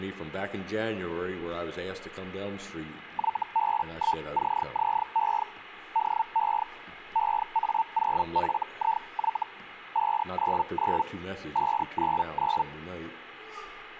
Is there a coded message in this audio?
Yes: Hellschreiber (Feld-Hell, 122.5 baud) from 3.1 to 12.6 s, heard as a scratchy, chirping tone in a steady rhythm, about 900 Hz. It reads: YB1CZE DE EA0FIY 599 599